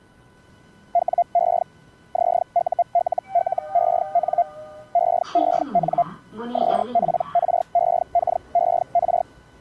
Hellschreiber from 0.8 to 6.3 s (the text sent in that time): WE ZULLEN EEN